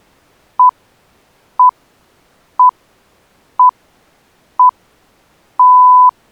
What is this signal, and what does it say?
Radio time signal (six pips, as the Greenwich Time Signal), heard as pips.